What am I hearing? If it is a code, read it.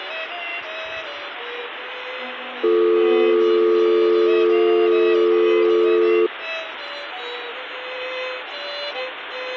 Telephone call progress tone (North American or UK plan), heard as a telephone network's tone, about 350, 440 Hz. Dial tone.